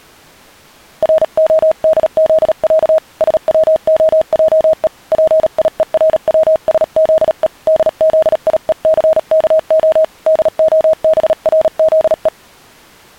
Morse code (with Polish letters), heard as a keyed tone, hand-sent with a paddle, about 37 wpm, 630 Hz. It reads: RODZĄ SWOJE PIERWSZE DZIECKO DOBRZE